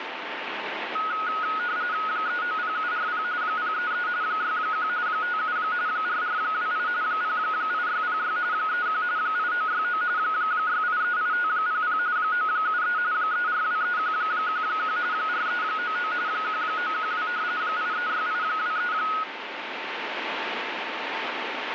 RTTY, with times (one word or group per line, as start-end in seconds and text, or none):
2.1-3.2 390740
3.4-4.1 033
4.2-4.9 61
5.1-5.6 57
5.9-6.9 4428
7.0-8.4 08606
8.5-9.0 31
9.2-10.0 8969
10.2-12.0 6838500
12.2-13.0 973
13.1-15.0 3423111
15.1-16.1 4399
16.3-17.3 1912
17.6-18.9 836823